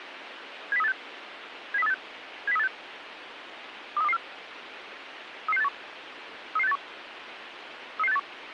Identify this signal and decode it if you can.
Five-tone selective call (EEA), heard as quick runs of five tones, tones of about 40 ms, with radio hiss. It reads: 70386 70386 70386 23224 33681 33681 33681